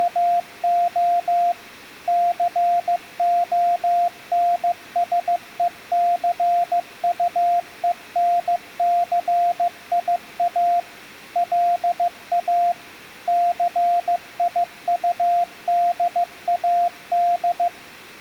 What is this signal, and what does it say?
Morse code, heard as a keyed tone, machine-sent, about 15 wpm, 700 Hz. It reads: … CONSECUENCIA LA CIUDAD